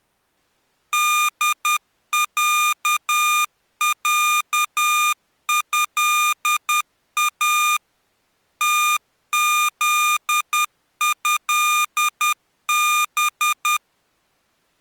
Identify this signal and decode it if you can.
Morse code (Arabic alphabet), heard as electronic beeps, machine-sent, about 10 wpm, 1210 Hz. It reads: دععها تذهب